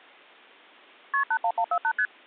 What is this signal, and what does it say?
Multi-frequency trunk signalling (R1, as on North American trunks), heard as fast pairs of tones, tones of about 70 ms. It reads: KP 81148 ST